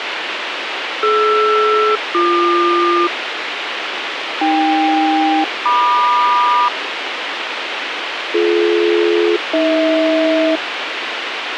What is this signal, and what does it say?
Aircraft SELCAL, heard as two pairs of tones, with radio hiss. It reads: DR-BQ AK-MQ BD-AH